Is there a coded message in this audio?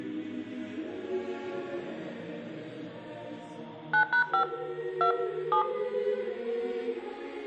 Yes: DTMF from 3.9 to 5.6 s, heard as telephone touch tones, dialled by hand, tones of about 100 ms, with room echo. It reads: 9#5 2 7